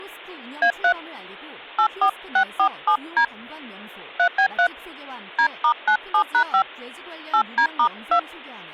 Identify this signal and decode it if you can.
DTMF, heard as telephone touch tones, dialled by hand, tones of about 80 ms, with speech in Korean. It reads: A3 84647D 3B3 D*97#5 8D*2